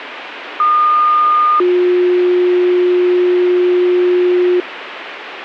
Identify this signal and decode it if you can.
Two-tone page, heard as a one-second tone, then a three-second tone, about 1220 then 360 Hz, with radio hiss and a squelch burst at the end.